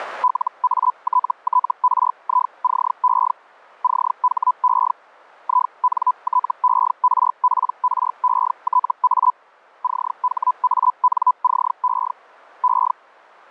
Hellschreiber (Feld-Hell, 122.5 baud), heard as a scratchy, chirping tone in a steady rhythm, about 1000 Hz. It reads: LATTRICE CHE INTERPRETA CHANCE E